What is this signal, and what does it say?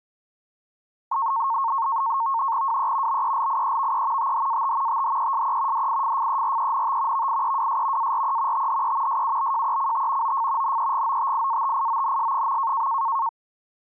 NAVTEX (SITOR-B), 100 baud, 170 Hz shift, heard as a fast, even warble, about 1000 Hz centre. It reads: WE BELIEVE THAT THESE DIFFERENT VIEWS ARE THE SUBJECT OF NEGOTIATIONS.